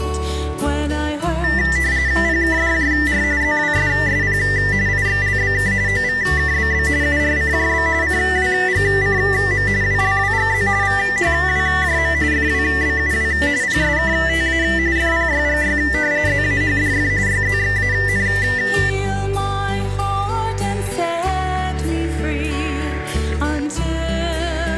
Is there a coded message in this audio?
Yes: RTTY (45.45 baud, 170 Hz shift) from 1.4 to 18.9 s, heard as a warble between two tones, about 1900 Hz centre, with static crashes. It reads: PKDJR ZWSSP IXLBK OVKBB URCJB CWGCM WLWGZ VHWJM FWBUW PSKTA FPYGY ZAHDF YZXAN